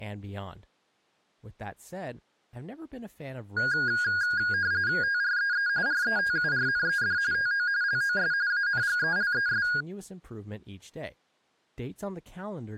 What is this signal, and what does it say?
RTTY (45.45 baud, 170 Hz shift), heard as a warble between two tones, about 1550 Hz centre, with speech in English. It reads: TREE RETURNED TO LOS ANGELES